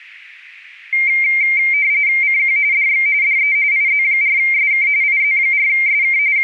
RTTY (45.45 baud, 170 Hz shift), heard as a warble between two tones, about 2200 Hz centre. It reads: CQ DX DE IZ4SK IZ4SK …